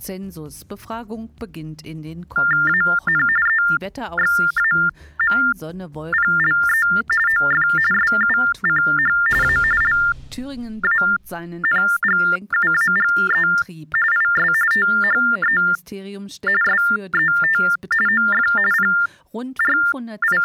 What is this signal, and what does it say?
TTY/TDD text telephone tones (45.45 baud Baudot), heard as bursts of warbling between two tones, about 400 Hz shift, 1600 Hz centre. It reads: AN EXAMPLE OF SUCH A LANGUAGE IS THE SET OF …